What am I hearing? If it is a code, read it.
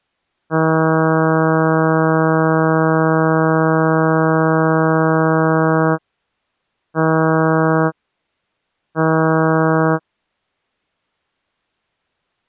Ship horn signal, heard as a ship's horn, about 160 Hz. 1 long, 2 short. At sea: a vessel in fog that is sailing, fishing, towing or hampered.